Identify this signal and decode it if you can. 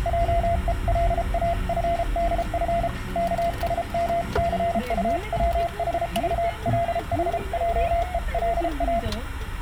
Morse code (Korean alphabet), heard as a keyed tone, hand-sent with a paddle, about 33 wpm, 680 Hz, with room echo and the noise inside a car. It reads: 하고는 염치불구하고